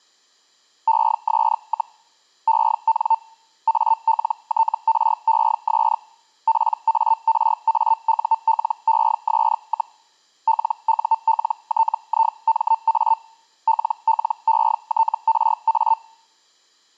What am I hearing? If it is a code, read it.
Hellschreiber (Feld-Hell, 122.5 baud), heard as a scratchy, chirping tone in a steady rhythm, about 900 Hz. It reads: ES, EN ALTRES PARAULES, LULTIMA LLETRA